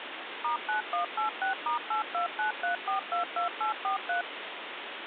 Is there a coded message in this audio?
Yes: DTMF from 0.4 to 4.2 s, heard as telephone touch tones, dialled by machine, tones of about 120 ms, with phone line noise. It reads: *9186*8293422843